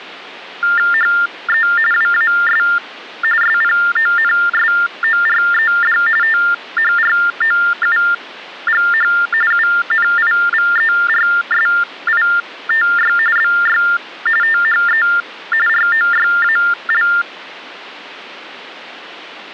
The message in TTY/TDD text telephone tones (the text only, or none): HE WAS SPONSORED THROUGH UNIVERSITY BY THE ROYAL